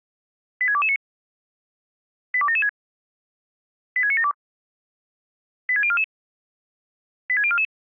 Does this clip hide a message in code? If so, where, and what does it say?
Yes: five-tone selective call (ZVEI) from 0.6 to 7.6 s, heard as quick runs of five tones, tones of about 70 ms. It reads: 86229 82776 86972 86044 86044